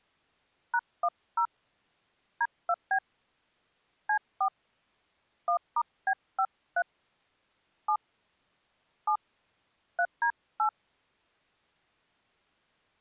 DTMF, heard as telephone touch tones, dialled by hand, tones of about 70 ms. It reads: #10 D2B C4 1*B53 7 7 3D8